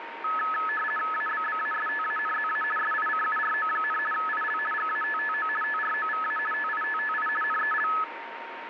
RTTY (50 baud, 450 Hz shift), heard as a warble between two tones, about 1500 Hz centre, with radio static and a steady whistle near 930 Hz. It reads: ABBASTANZA SICURO, IL GATTO TROVA TITTI NEL